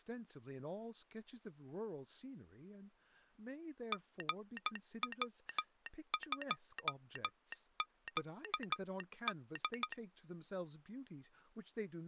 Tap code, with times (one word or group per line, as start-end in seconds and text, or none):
none